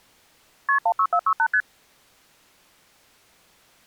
Multi-frequency trunk signalling (R1, as on North American trunks), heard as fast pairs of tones, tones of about 70 ms. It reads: KP 16468 ST